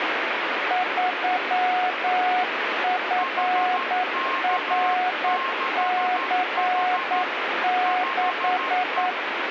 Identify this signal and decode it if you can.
Morse code, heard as two keyed tones, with radio static. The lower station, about 9 wpm, 730 Hz: 3FRC6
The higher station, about 13 wpm, 1070 Hz: HK6H 5E